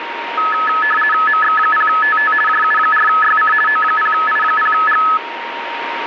RTTY (50 baud, 450 Hz shift), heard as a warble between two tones, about 1500 Hz centre, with radio static and a steady whistle near 930 Hz. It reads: MX0TT JU4YC O0I0G